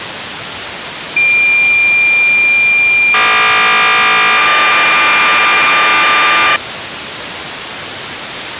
Cassette data (Kansas City type), 1200 baud, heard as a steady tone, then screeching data, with tape hiss.